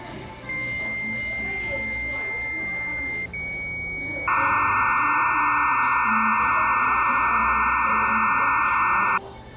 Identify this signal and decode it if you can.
Dial-up modem handshake (low-speed, two carriers), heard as two whistles, then hiss, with the noise of a cafe.